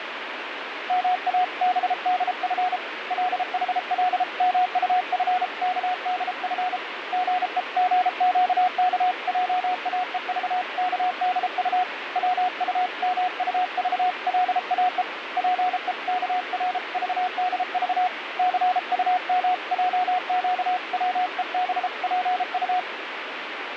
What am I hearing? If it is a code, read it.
Morse code (Korean alphabet), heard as a keyed tone, hand-sent with a paddle, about 33 wpm, 730 Hz, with radio static. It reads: 모든 국민은 사생활의 비밀과 자유를 침해받지